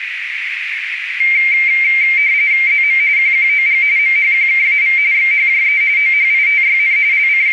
RTTY (45.45 baud, 170 Hz shift), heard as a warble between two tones, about 2200 Hz centre, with radio static and a narrow filter. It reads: ZM QQOG MHQKAV XHJE OHITYN …